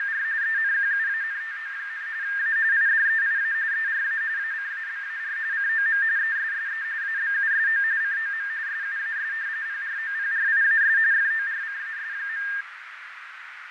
RTTY (45.45 baud, 170 Hz shift), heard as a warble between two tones, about 1700 Hz centre, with radio static, fading and a narrow filter. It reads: … ENQUANTO, A IDEIA ERA ACABAR COM ESSE ABUSO COM SUAS PROPRIAS FORCAS.